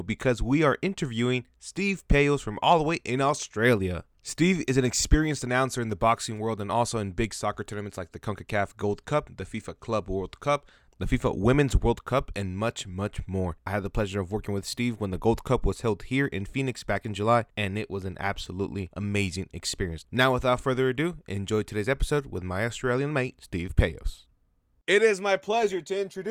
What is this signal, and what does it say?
Speech in English. There is no code.